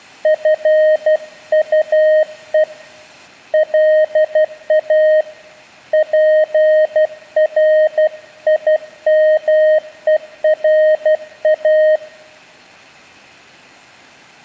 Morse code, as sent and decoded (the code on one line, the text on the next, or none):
..-. ..- . / .-.. .- / .--. .-. .. -- . .-. .-
FUE LA PRIMERA